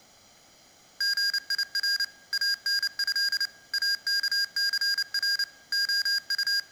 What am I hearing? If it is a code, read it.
Morse code (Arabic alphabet), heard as electronic beeps, machine-sent, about 29 wpm, 1600 Hz, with room echo. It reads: غير انه اكثر …